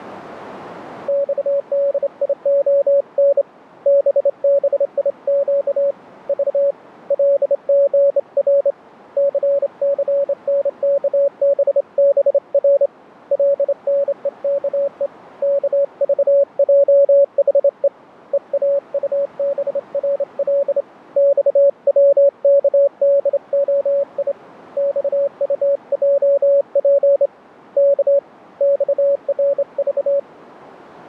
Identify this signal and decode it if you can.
Morse code, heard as a keyed tone, hand-sent with a straight key, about 27 wpm, 560 Hz. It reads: XDION BBIQ V LGR CCNKBBR LNEKE KVJHE EAUBRL XWKDOI XUJP K XRV